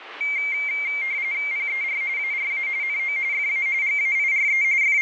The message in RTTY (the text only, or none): PER ARA NO FA GAIRE …